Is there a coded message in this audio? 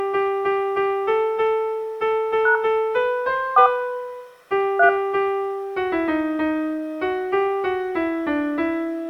Yes: DTMF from 2.5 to 4.9 s, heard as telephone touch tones, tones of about 100 ms, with room echo. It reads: # 4 3